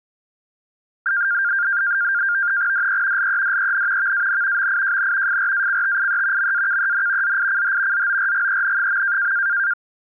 NAVTEX (SITOR-B), 100 baud, 170 Hz shift, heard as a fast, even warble, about 1500 Hz centre. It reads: DE LEDEN VAN MIJN FRACTIE MAKEN ZICH ZORGEN.